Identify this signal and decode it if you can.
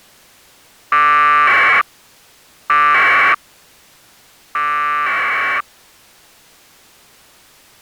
Packet radio (AX.25, as in APRS), 1200 baud, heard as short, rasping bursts.